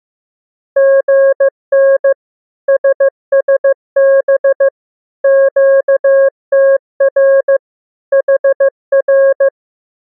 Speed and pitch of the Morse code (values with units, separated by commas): 15 wpm, 540 Hz